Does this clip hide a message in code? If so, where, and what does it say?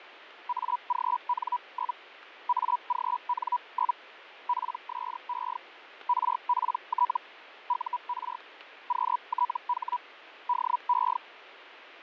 Yes: Hellschreiber (Feld-Hell, 122.5 baud) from 0.5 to 11.2 s, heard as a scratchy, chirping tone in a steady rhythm, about 980 Hz, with radio static and fading. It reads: AGN? AGN? PSE RPT UR QTH DE